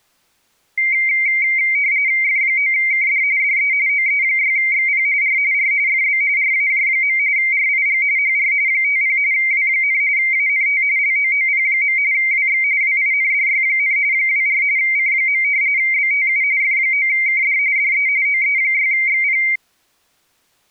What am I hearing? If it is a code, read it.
RTTY (45.45 baud, 170 Hz shift), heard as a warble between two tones, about 2200 Hz centre. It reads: F9KD DE OE6XP R R FB RAJ. RIG HR 50 W, ANT LOOP. WX WINDY, 24 C. BTU F9KD DE OE6XP